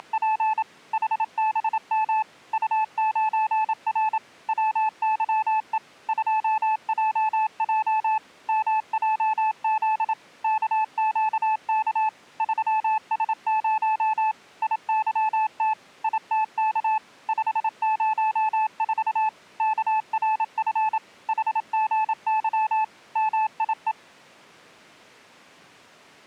Morse code, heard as a keyed tone, machine-sent, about 27 wpm, 870 Hz. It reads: … HBM U9R WYE 2JJ MJZ KQK 3S0 IYT ITK 504 KRF HGY MIE